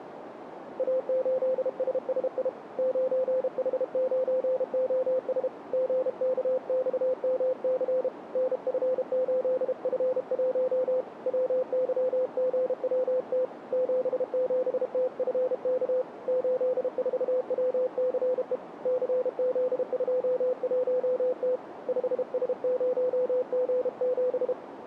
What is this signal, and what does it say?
Morse code, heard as a keyed tone, hand-sent with a paddle, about 32 wpm, 510 Hz, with radio static and a narrow filter. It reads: A8SSI 9H9OS GKXMC NF8F1 WYGWT 77TFK 84WCE CZ21T 5S0G7